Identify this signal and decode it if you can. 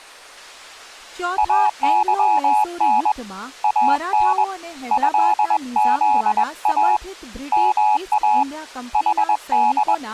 Morse code (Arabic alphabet), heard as a keyed tone, hand-sent with a paddle, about 21 wpm, 850 Hz, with speech in Gujarati. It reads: اظن ان هذا ما …